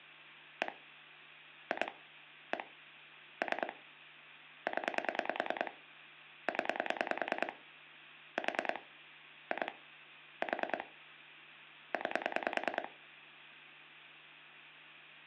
Pulse dialling, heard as clicks on a phone line, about 10 pulses a second, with hum. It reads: 1 2 1 3 0 0 4 2 4 9